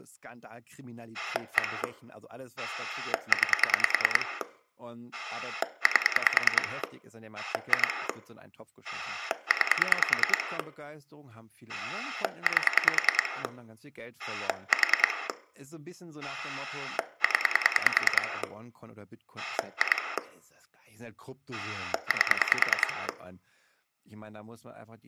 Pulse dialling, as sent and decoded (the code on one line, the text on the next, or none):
1 / 9 / 8 / 2 / 9 / 8 / 4 / 10 / 2 / 8
1 9 8 2 9 8 4 0 2 8